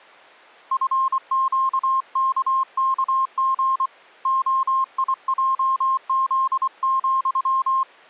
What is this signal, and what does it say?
Morse code, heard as a keyed tone, hand-sent with a paddle, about 24 wpm, 1060 Hz. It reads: FQKKG OIJZ,